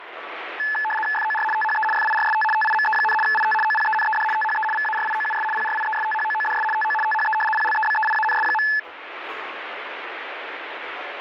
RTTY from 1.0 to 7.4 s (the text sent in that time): FOR THE FIRST TIME, IT OPENED THE VARIOUS PRIESTHOODS TO THE